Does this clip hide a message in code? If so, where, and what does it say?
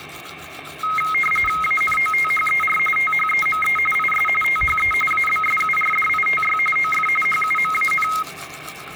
Yes: RTTY (45.45 baud, 850 Hz shift) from 0.8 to 8.2 s, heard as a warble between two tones, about 1700 Hz centre, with radio static, static crashes and the noise of a restroom. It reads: ANOTHER THEME IS THE ABSURDITY OF HUMAN